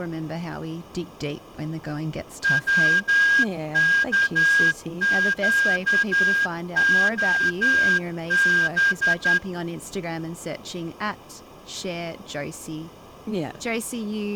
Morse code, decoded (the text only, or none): WKQOB